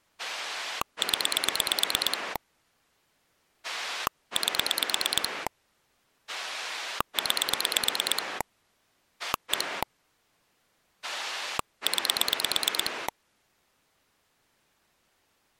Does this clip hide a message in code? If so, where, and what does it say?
Yes: pulse dialling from 0.2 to 13.1 s, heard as a rotary dial, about 9 pulses a second. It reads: 0 8 9 1 9